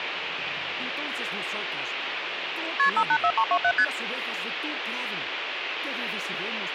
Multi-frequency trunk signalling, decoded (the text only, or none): KP 584327 ST